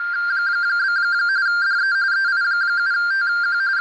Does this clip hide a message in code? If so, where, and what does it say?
Yes: RTTY (45.45 baud, 170 Hz shift) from 0.0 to 3.8 s, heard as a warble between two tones, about 1490 Hz centre, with radio static and a narrow filter. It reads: … DE EI7TQ …